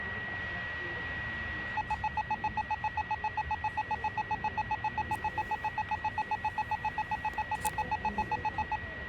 Evenly repeated beeps, with radio static, a steady whistle near 1920 Hz and the noise of a crowd indoors. There is no code.